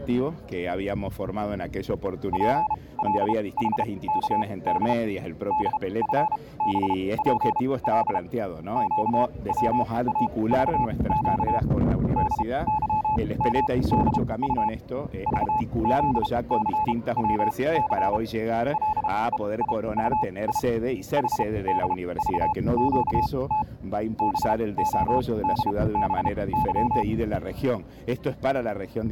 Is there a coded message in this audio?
Yes: Morse code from 2.3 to 27.1 s, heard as a keyed tone, machine-sent, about 32 wpm, spaced as for 22 wpm, 860 Hz. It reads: PLHKD DFBPL QWAVQ DYMDU VZCWC LEIUI HDVQT BODBY